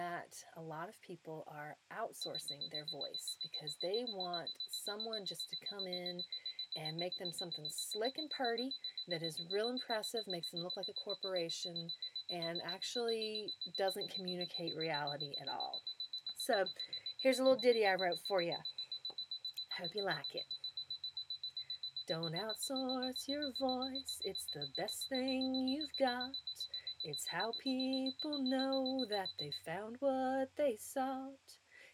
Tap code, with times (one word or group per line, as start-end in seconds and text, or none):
none